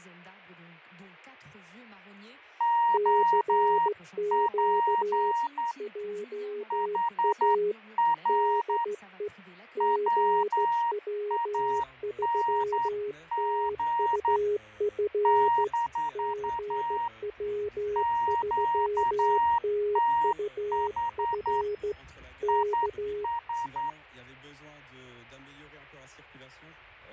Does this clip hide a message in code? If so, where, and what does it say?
Yes: Morse code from 2.5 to 24.0 s, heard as two keyed tones, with fading. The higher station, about 10 wpm, 940 Hz: OP HR WANG - QTH IS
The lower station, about 15 wpm, 410 Hz: CQ JA DE GW3TUF GW3TUF K